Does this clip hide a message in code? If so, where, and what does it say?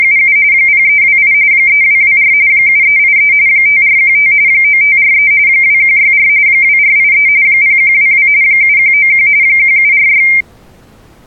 Yes: RTTY (45.45 baud, 170 Hz shift) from 0.0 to 10.4 s, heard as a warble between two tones, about 2200 Hz centre. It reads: … 0328 3224 7383 5415 9543 2164 2483 0122 7191 1746